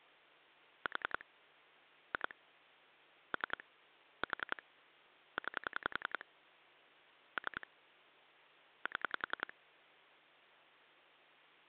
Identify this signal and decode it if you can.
Pulse dialling, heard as clicks on a phone line, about 10 pulses a second. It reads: 4 2 3 4 9 3 7